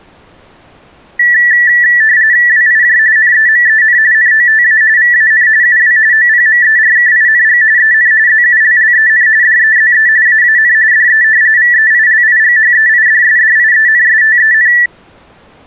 RTTY (45.45 baud, 170 Hz shift), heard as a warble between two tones, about 1850 Hz centre. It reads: WIJ NEMEN NOTA VAN UW OPMERKING EN ZULLEN DEZE AAN DE VEILIGHEIDSDIENSTEN